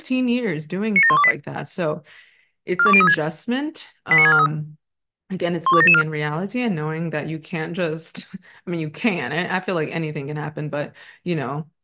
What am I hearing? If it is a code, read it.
Five-tone selective call (ZVEI), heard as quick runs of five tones, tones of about 70 ms, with speech in English. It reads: 97128 42036 89643 12774